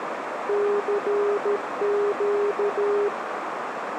Morse code, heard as a keyed tone, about 13 wpm, 410 Hz, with radio static and a narrow filter. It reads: CQ